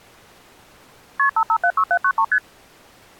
Multi-frequency trunk signalling (R1, as on North American trunks), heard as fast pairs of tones, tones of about 70 ms. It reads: KP 5576793 ST